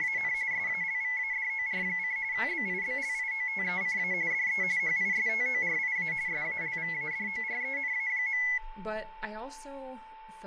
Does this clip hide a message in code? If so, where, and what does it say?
Yes: RTTY (45.45 baud, 170 Hz shift) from 0.0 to 8.6 s, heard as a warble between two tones, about 2100 Hz centre, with a steady whistle near 880 Hz and speech in English. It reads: … SALVADOR: BIBLIOTECA DE HISTORIA SALVADORENA.